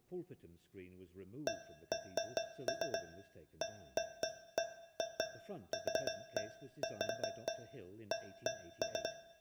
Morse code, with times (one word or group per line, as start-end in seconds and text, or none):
none